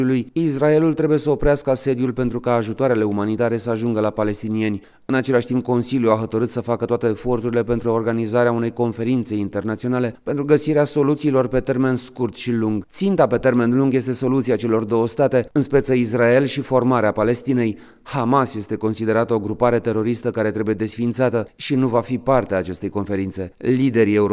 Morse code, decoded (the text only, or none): none